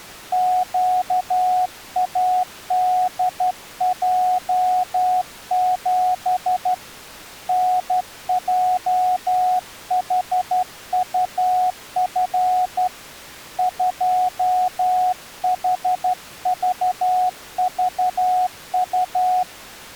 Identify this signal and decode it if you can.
Morse code, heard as a keyed tone, hand-sent with a straight key, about 12 wpm, 730 Hz. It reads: QADJ7 NJHUF 2HVVU